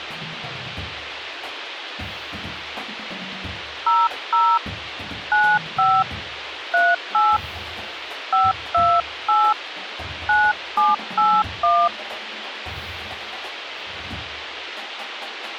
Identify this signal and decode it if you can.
DTMF, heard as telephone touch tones, dialled by hand, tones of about 220 ms, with radio hiss. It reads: 00 95 38 528 9781